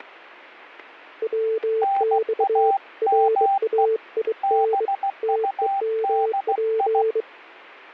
Morse code, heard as two keyed tones, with static crashes. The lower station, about 23 wpm, 440 Hz: WX RAIN TEMP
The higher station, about 16 wpm, 790 Hz: NAME BUDI